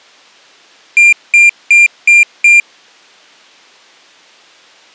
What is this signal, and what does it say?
Beep code, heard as a piezo beeper, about 2400 Hz. 5 short. In AMI BIOS tables: processor failure; in Dell tables: CMOS battery failure.